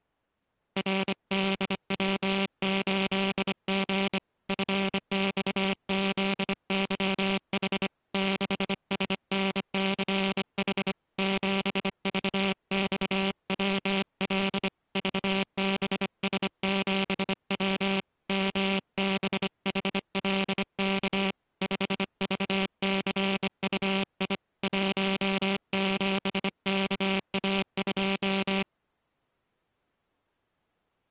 Morse code, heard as a buzzer, hand-sent with a bug key, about 25 wpm. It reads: RDW8G FXZYH 6SNCH 7VXWL VBS7W MBHLK 5VCUI 17KA2